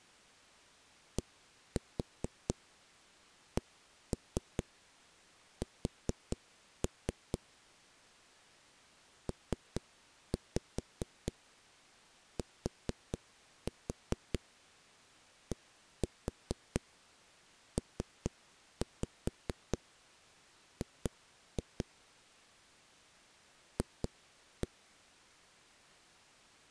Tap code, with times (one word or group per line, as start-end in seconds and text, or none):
1.2-7.4 DCS
9.3-21.9 PTDPG
23.8-24.7 F